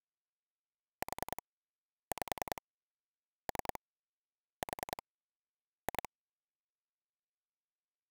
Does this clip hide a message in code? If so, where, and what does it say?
Yes: pulse dialling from 1.0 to 6.1 s, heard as clicks on a phone line, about 10 pulses a second. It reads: 4 5 3 4 2